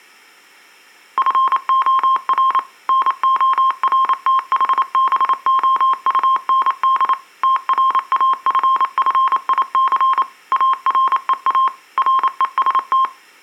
Morse code, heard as a keyed tone, machine-sent, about 28 wpm, 1060 Hz. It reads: FOR NORTHBOUND TRAFFIC AREA REST